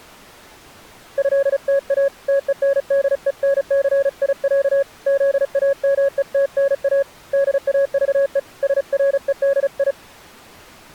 Morse code (Russian alphabet), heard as a keyed tone, hand-sent with a paddle, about 35 wpm, 550 Hz. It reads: ЭТА ТЕНДЕНЦИЯ ЗАМЕТНА ДАЖЕ СРЕДИ